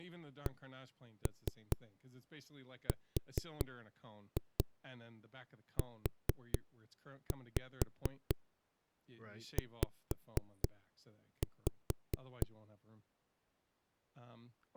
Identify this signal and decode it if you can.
Tap code, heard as knocks on a wall, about 4 knocks a second, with speech in English. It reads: CRUZ